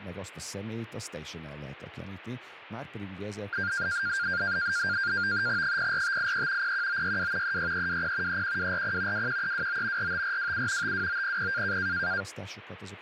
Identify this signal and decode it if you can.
NAVTEX (SITOR-B), 100 baud, 170 Hz shift, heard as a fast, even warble, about 1500 Hz centre, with radio static and speech in Hungarian. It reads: 04583 01962 36320 31240 21329 45427 52900